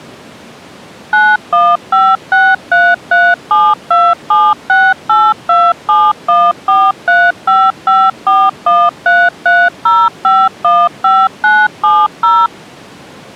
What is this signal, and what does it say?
DTMF, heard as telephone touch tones, dialled by machine, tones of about 230 ms. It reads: 91563372768271435541330515970